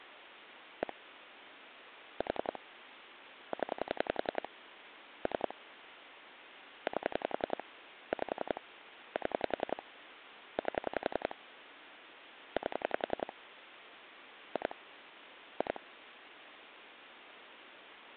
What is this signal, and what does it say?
Pulse dialling, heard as clicks on a phone line, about 11 pulses a second, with phone line noise. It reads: 1 4 0 3 8 5 7 8 8 2 2